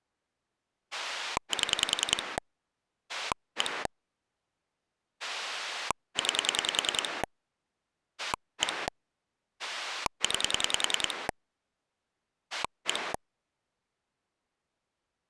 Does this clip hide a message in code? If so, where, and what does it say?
Yes: pulse dialling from 0.9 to 13.2 s, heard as a rotary dial, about 10 pulses a second. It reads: 7 1 9 1 9 1